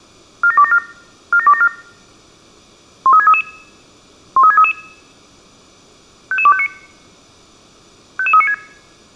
Five-tone selective call (ZVEI), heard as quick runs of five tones, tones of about 70 ms. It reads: 47274 47274 13633 13633 55259 55396